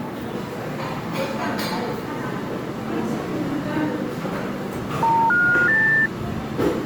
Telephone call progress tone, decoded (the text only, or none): special information tone